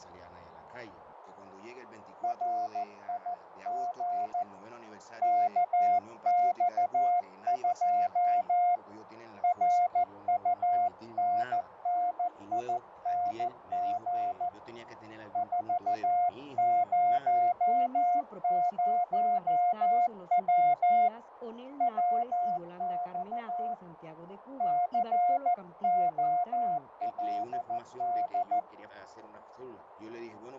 Morse code, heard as a keyed tone, hand-sent with a paddle, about 14 wpm, 710 Hz, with radio static, fading and a narrow filter. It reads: RIG KX2 RUNNING 400W WX COLD